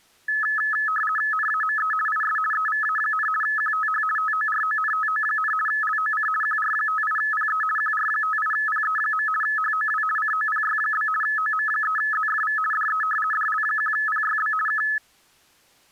RTTY (50 baud, 450 Hz shift), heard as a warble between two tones, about 1500 Hz centre. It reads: NAME IS EVA, QTH TORONTO, LOC QR58PE QR58PE. HOW COPY? OM3ZFV DE DL1PYB K